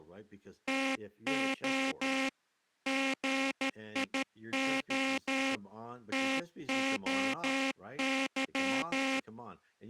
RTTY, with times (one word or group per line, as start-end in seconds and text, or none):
none